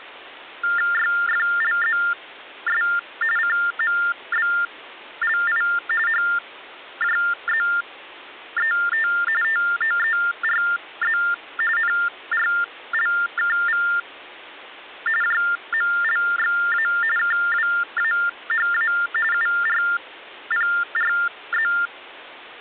TTY/TDD text telephone tones (45.45 baud Baudot), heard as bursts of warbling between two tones, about 400 Hz shift, 1600 Hz centre. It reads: YFLZS CMBLI HJZET TOERZ NRLKV JMLXA KWAHA URPRZ